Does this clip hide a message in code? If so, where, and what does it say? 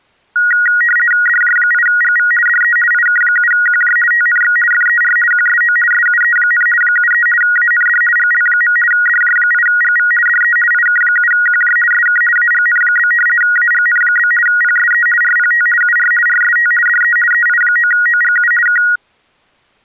Yes: RTTY (50 baud, 450 Hz shift) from 0.4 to 19.0 s, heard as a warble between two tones, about 1650 Hz centre. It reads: DJ8GV DE IK7QJ TNX FER QSO SUE, 73 AND GL. DJ8GV DE IK7QJ SK AGN? AGN? PSE RPT UR RST DE EI9OGU K